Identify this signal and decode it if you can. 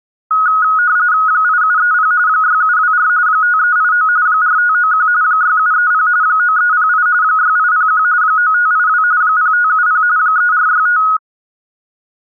RTTY (45.45 baud, 170 Hz shift), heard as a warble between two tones, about 1360 Hz centre. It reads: 8730 6724 5389 4591 6730 9308 6801 9582 0570 3465